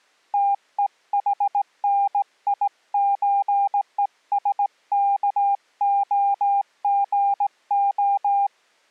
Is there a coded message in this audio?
Yes: Morse code (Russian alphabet) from 0.3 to 8.5 s, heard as a keyed tone, hand-sent with a straight key, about 17 wpm, 800 Hz. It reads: ТЕХНИЧЕСКОГО